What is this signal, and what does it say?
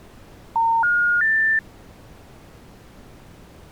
Telephone call progress tone (North American plan), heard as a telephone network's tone, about 910, 1430, 1800 Hz. Special information tone.